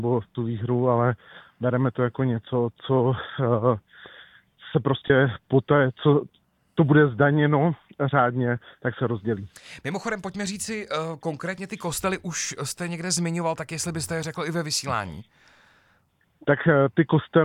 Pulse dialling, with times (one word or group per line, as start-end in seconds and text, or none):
none